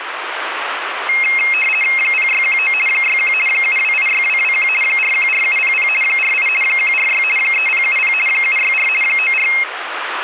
RTTY (50 baud, 450 Hz shift), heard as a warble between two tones, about 2350 Hz centre, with radio static. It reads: 0619 61 7286221 414700 48 146 3070 764 94